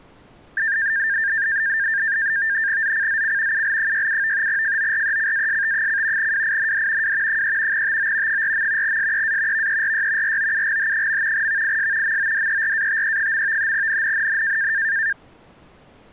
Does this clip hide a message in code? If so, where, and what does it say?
Yes: NAVTEX (SITOR-B), 100 baud, 170 Hz shift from 0.6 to 15.1 s, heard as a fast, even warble, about 1700 Hz centre. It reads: ZCZC UL67 FORECAST: WIND W 3 TO 4. SEA VERY ROUGH. VIS MODERATE. NNNN